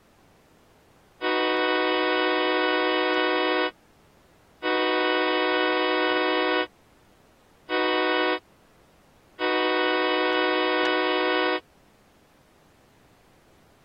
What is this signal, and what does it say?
Train horn signal, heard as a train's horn. 2 long, 1 short, 1 long. On North American railways: approaching a public crossing.